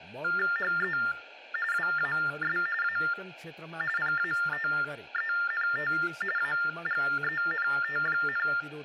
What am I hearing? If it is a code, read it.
TTY/TDD text telephone tones (45.45 baud Baudot), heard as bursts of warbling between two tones, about 400 Hz shift, 1600 Hz centre, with speech in Nepali. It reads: HE WAS A PATENT AGENT,